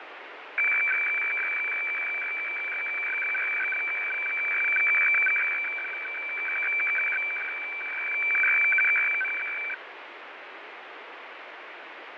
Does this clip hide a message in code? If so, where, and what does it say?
Yes: weather fax (radiofax), 120 lines a minute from 0.6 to 9.7 s, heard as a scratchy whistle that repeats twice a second, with radio static and fading.